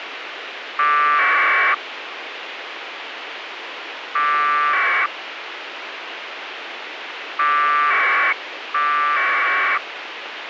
Packet radio (AX.25, as in APRS), 1200 baud, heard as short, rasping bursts, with radio hiss and a squelch burst at the end.